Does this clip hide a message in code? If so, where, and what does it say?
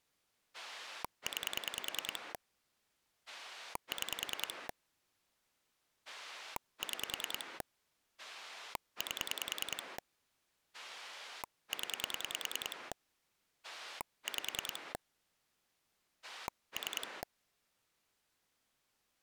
Yes: pulse dialling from 0.5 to 17.2 s, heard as a rotary dial, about 10 pulses a second. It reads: 9 6 6 8 0 5 3